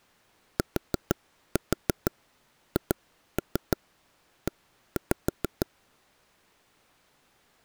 Tap code, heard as taps on a table, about 6 knocks a second. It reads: THE